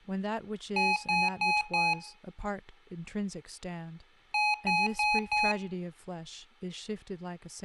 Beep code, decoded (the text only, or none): 4 short